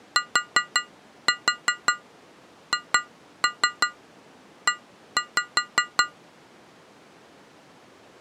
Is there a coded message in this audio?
Yes: tap code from 0.2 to 6.2 s, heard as taps on glass, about 5 knocks a second. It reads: THE